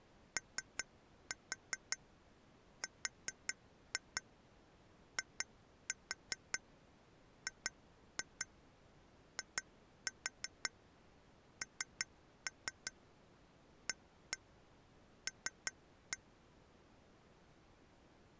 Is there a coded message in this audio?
Yes: tap code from 0.4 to 16.2 s, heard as taps on glass, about 5 knocks a second. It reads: ORIGINAL